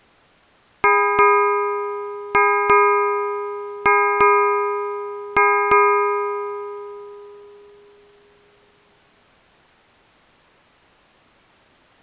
Ship's bell, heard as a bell. 8. Eight half-hours of the watch have passed.